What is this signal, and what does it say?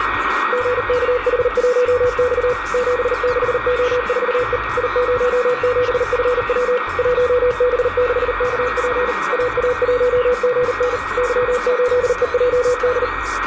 Morse code, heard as a keyed tone, machine-sent, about 39 wpm, 500 Hz, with radio static, a steady whistle near 1880 Hz and room echo. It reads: GKH1X 76O4E I07FW 1B6KP AA1GN Y8EJD